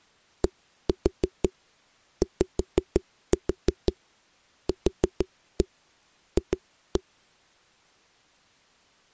Tap code, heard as knocks on a wall, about 6 knocks a second. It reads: DYQF